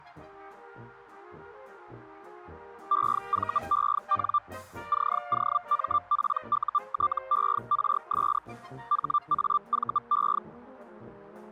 Hellschreiber (Feld-Hell, 122.5 baud), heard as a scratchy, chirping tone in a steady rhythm, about 1180 Hz. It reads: EVEN COMPUTERS HAVE